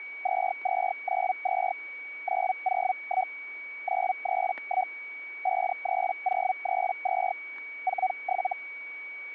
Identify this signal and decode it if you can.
Hellschreiber (Feld-Hell, 122.5 baud), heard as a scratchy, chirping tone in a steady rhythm, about 750 Hz, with static crashes and a steady whistle near 2260 Hz. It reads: 2292 901 931 53032 47